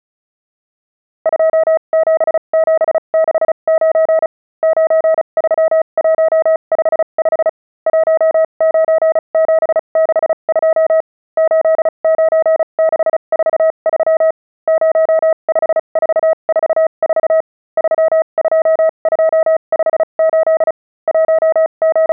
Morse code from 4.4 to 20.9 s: 93155 19762 89643 05444 32258

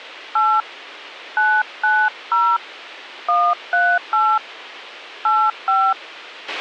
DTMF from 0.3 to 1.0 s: 8

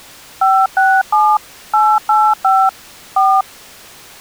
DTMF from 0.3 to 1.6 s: 567

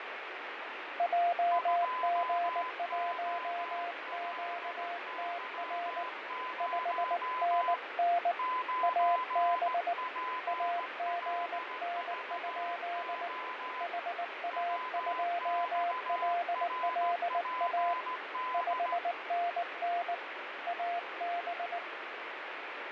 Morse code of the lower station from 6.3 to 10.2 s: 5NN AB

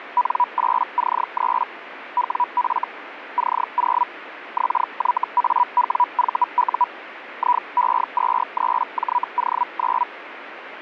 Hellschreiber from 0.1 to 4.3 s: N8C3 WF C0

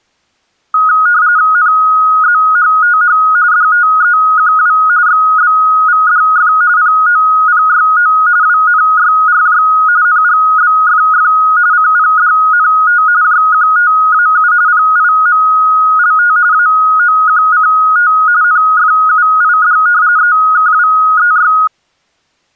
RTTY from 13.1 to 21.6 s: JQTAU PIMLT AOQCT NFUID EKWEY

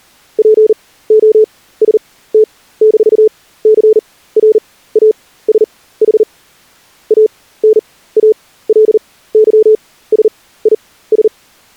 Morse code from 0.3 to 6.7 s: POST-CRASH

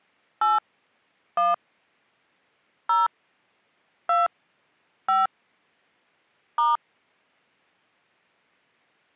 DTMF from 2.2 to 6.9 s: 0 2 5 *

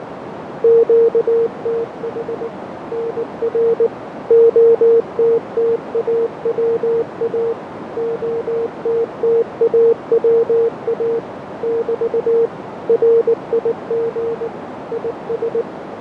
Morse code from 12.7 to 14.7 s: RIG

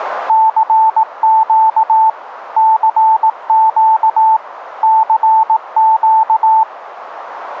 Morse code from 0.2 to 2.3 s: CQ

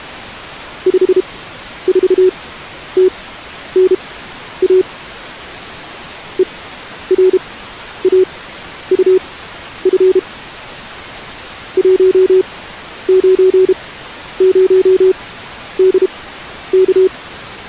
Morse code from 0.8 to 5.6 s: 54TNA

